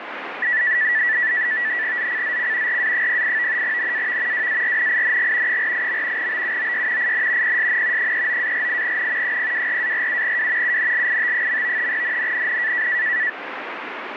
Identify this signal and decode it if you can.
NAVTEX (SITOR-B), 100 baud, 170 Hz shift, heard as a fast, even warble, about 1850 Hz centre, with radio static. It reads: ZCZC RA08 NAV WARNING 48. BUOY IN PSN 39-48N 024-47W UNLIT. NNNN